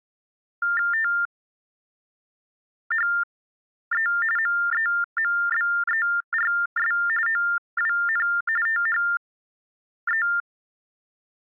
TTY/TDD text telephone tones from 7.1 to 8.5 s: OWN

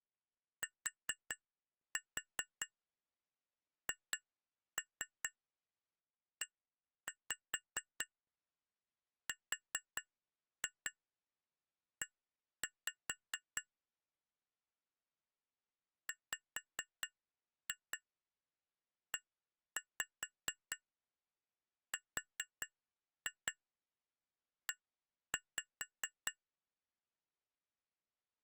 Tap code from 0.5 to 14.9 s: THERE

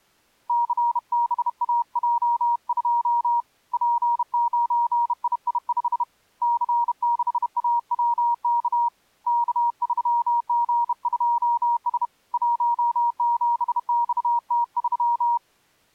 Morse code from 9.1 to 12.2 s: K3G2S

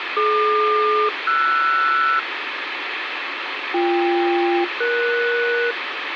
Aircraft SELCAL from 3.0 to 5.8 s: BK-ES

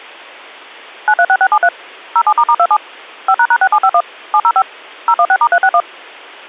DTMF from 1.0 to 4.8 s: 936673 07**27 5##6751 705

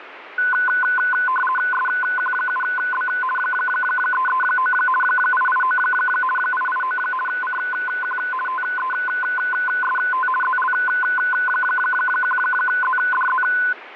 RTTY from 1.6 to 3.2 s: SQ7B

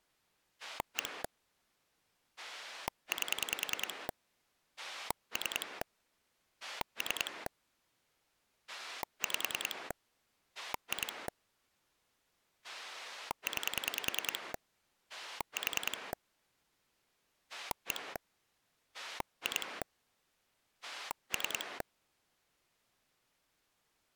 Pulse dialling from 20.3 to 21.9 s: 3

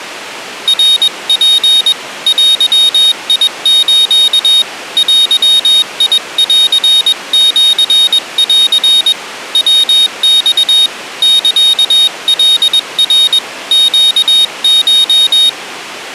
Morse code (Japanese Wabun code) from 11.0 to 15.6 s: サカナ ネコ

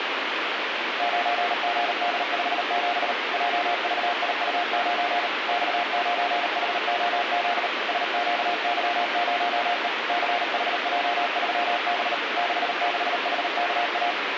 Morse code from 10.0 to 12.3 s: CHJ3B

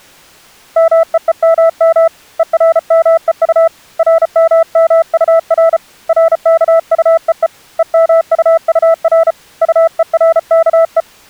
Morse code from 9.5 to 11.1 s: UERKE

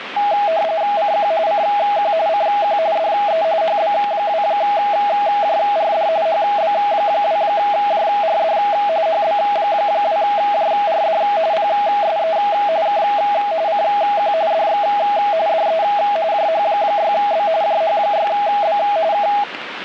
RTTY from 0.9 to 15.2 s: CQ CQ CQ DE HB2JRD HB2JRD HB2JRD PSE K CQ DX

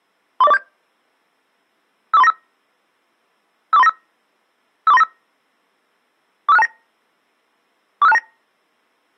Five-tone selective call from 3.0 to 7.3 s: 54395 54395 45629

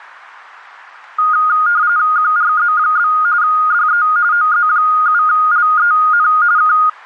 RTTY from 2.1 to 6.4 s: QRZ? DE OZ7LEN

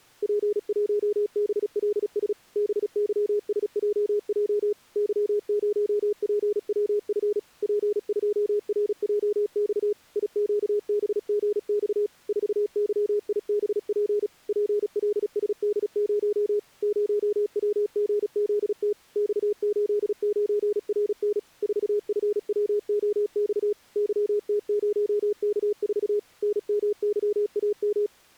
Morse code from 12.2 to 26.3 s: 4YIBP PLSD0 0WGZT X89RN 4FWOX YT0K4

